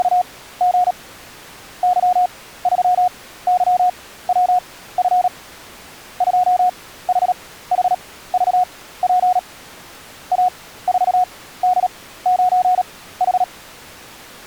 Morse code, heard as a keyed tone, machine-sent, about 37 wpm, spaced as for 17 wpm, 730 Hz. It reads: … Y3YWF 2HHVP A4D9H